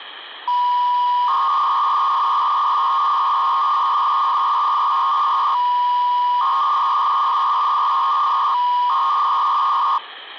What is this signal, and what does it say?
300-baud modem data (V.21 tones), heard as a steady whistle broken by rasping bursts, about 300 baud, 200 Hz shift, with phone line noise.